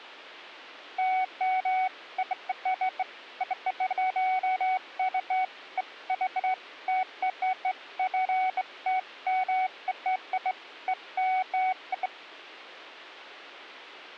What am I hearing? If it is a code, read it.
Beeps of irregular length. There is no code.